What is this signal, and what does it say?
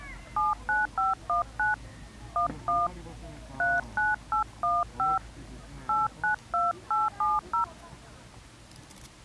DTMF, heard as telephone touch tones, dialled by hand, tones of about 150 ms, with the noise of a park. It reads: 79519 11 39815 892870